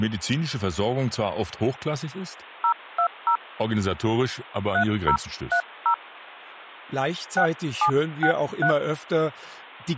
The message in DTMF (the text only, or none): 020 3030 6763